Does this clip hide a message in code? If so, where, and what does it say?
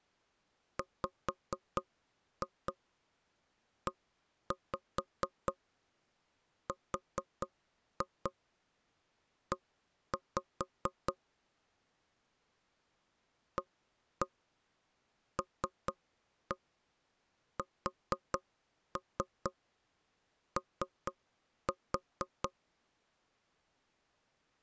Yes: tap code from 0.8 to 22.5 s, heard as knocks on wood, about 4 knocks a second. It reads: WERE ALSO